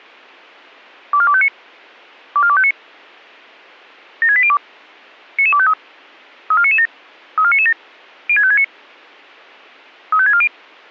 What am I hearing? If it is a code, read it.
Five-tone selective call (ZVEI), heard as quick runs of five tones, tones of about 70 ms, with a squelch burst at the end. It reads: 24259 24259 76802 99253 34997 34997 06569 35640